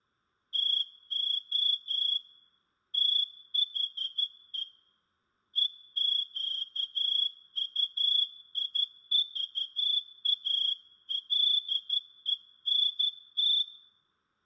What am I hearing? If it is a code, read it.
Morse code, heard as a whistle, hand-sent with a straight key, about 12 wpm, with room echo. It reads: TO THE EQUIVALENT